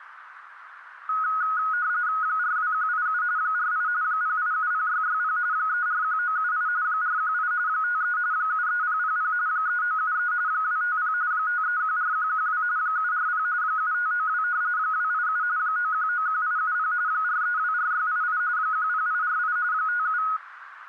RTTY (45.45 baud, 170 Hz shift), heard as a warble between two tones, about 1360 Hz centre, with radio static. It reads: 42187 48 0870660 341978 418 53 73000 3973 250 5314112 740 7592 287 9191870 4324688 10848 57